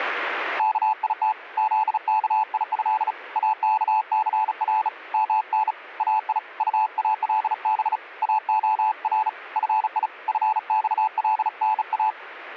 Morse code (Arabic alphabet), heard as a keyed tone, hand-sent with a bug key, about 36 wpm, 870 Hz. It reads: كيت ذكيه اكثر من اي طالب اخر في فصلنا